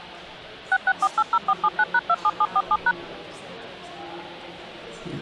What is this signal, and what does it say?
DTMF, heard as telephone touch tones, dialled by machine, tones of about 50 ms. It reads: 66480479#27747#